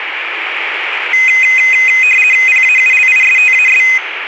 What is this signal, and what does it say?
RTTY (50 baud, 450 Hz shift), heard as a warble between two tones, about 2300 Hz centre, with radio static. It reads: PAULISTAS